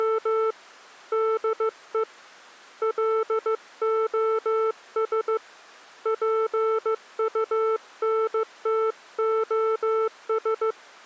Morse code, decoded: … DE LOS PUNTOS

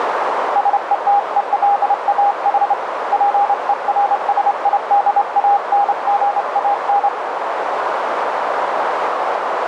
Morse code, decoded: SETELAH PERSIDANGAN

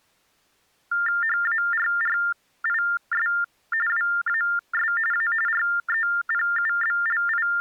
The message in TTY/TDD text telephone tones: HARRIS WAS A …

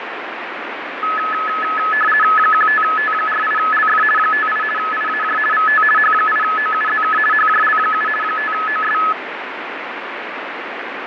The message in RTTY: 15T48LF 58 IAJ VT H8OUZK HJL7 5OS

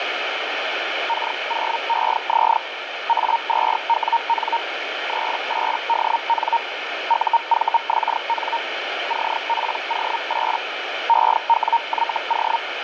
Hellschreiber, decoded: K0EZ A2WN 38DN UVXN CPO8 EWYO

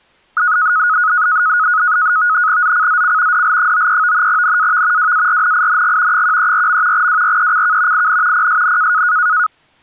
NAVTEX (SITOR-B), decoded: ZCZC DL93 NAV WARNING 134. WRECK IN PSN

